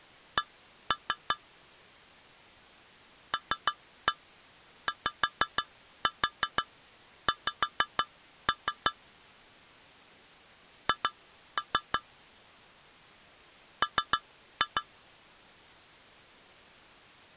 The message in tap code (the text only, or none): C LYX H M